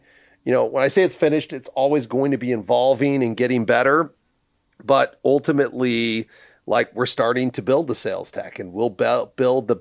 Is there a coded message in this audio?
No, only speech in English.